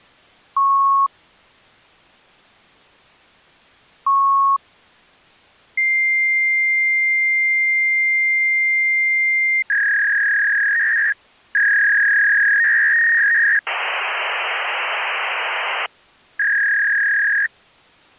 Fax machine handshake, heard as beeps, a long tone, a warble and hiss.